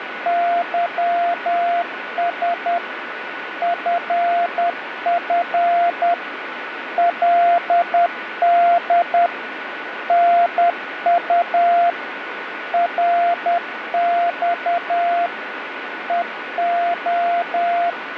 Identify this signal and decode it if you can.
Morse code, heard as a keyed tone, machine-sent, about 10 wpm, 690 Hz, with radio static and a steady whistle near 1480 Hz. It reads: YS FF LD NU RX EO